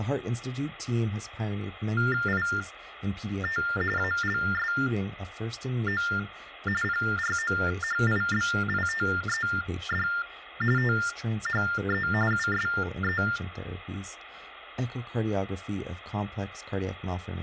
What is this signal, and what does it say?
TTY/TDD text telephone tones (45.45 baud Baudot), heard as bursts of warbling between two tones, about 400 Hz shift, 1600 Hz centre, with phone line noise and speech in English. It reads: IT ALSO PROHIBITED THE USE